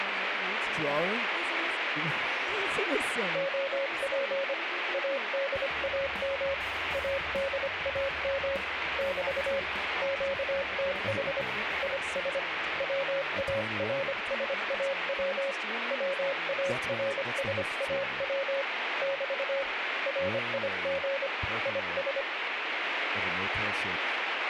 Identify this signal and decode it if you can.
Morse code, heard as a keyed tone, hand-sent with a paddle, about 25 wpm, 550 Hz, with radio static. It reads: OP ADAM ADAM <BT> QTH IS WARSAW WARSAW <BT> RIG IS